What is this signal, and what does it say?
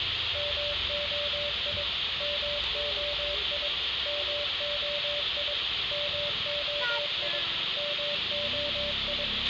Morse code, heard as a keyed tone, machine-sent, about 22 wpm, 580 Hz, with radio hiss, a squelch burst at the end, room echo and street noise. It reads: MOI MOI MOI MOI MOI